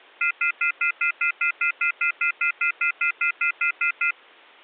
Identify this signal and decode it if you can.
Telephone call progress tone (North American plan), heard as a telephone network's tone, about 1400, 2050, 2450, 2600 Hz, 0.1 s on and 0.1 s off. Off-hook warning tone.